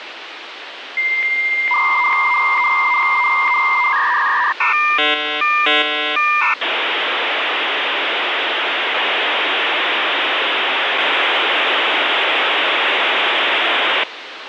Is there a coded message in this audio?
Yes: dial-up modem handshake (V.34 or later) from 1.0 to 14.0 s, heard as a whistle, warbles, then hiss, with phone line noise.